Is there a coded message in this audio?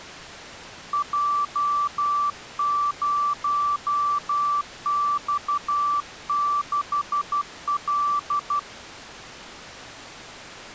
Yes: Morse code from 0.9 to 8.7 s, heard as a keyed tone, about 12 wpm, 1160 Hz. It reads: J0X6L